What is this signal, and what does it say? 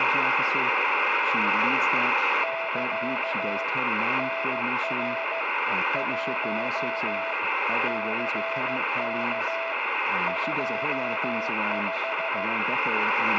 Morse code, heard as a keyed tone, machine-sent, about 15 wpm, 660 Hz, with radio static, a steady whistle near 2110 Hz, room echo and speech in English. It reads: <KA> NR 1 CK 25